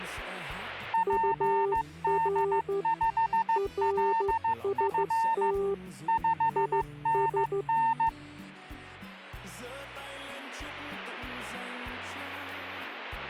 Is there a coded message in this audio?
Yes: Morse code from 0.9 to 8.1 s, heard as two keyed tones. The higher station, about 15 wpm, 900 Hz: PD5LF 5NN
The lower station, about 13 wpm, 400 Hz: UR RST IS